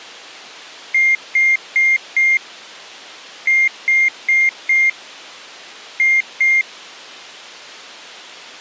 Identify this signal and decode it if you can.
Beep code, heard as beeps, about 2100 Hz. 4-4-2. In Phoenix BIOS tables: parallel port failure.